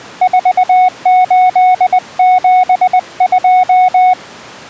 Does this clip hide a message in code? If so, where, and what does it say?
Yes: Morse code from 0.2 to 4.2 s, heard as a keyed tone, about 20 wpm, 740 Hz. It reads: 4872